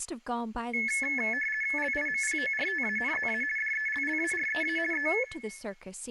RTTY (50 baud, 450 Hz shift), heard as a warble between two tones, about 1950 Hz centre, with room echo and speech in English. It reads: LIMPORTANZA DELLAREA E